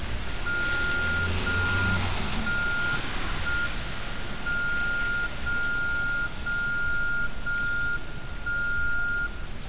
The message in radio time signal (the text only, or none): 0 1 1 M 0 0 0 1 0